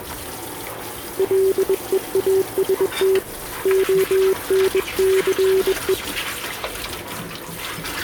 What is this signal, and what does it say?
Morse code, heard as a keyed tone, hand-sent with a bug key, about 21 wpm, 380 Hz, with kitchen noise. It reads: LEAST ONCE